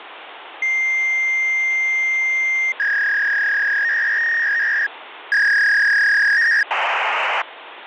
Fax machine handshake, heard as a long tone, a warble and hiss, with phone line noise.